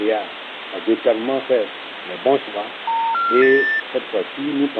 Telephone call progress tone (North American plan), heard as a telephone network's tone, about 910, 1370, 1800 Hz, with phone line noise. Special information tone.